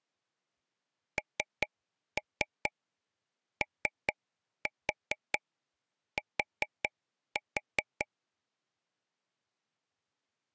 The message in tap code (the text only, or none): NOT